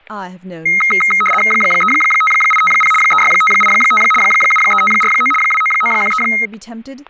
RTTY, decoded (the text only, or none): 35850 36585 73549 29913